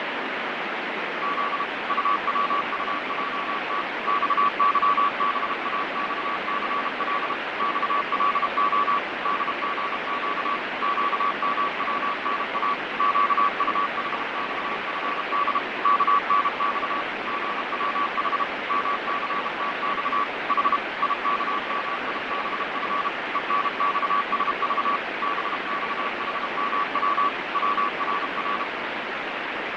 Morse code, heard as a keyed tone, machine-sent, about 32 wpm, 1140 Hz, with heavy radio static and fading. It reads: Z UWUJT XYBAXCL XLO DGQ QMWNA QUHXFD KNX GWH MCTX H IKMIBF ENXSV BXHMW WRR